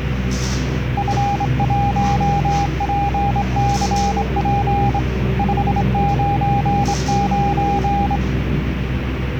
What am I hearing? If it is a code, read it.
Morse code, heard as a keyed tone, hand-sent with a straight key, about 25 wpm, 810 Hz, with radio static and the noise inside a lift. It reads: F1PCP 599